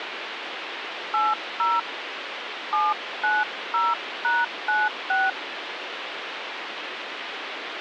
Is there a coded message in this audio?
Yes: DTMF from 1.1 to 5.3 s, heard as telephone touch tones, dialled by hand, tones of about 200 ms, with phone line noise. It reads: 80 790#96